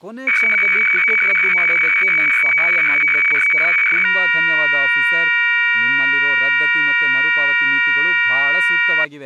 Weather fax (radiofax), 120 lines a minute, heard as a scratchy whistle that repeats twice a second, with speech in Kannada.